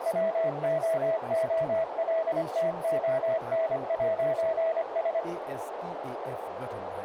Morse code, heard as a keyed tone, machine-sent, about 25 wpm, 650 Hz, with radio static, a narrow filter and speech in Nepali. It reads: WOOLTON'S